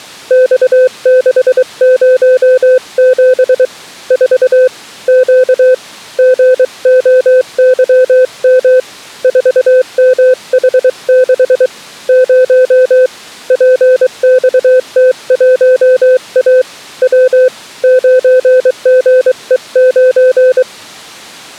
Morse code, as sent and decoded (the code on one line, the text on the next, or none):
-..- -.... ----- --... / ....- / --.- / --. --- -.-- -- / ....- -- .... -.... / ----- / .--. -..- - .---- .- / .-- / ----. --. . ----.
X607 4 Q GOYM 4MH6 0 PXT1A W 9GE9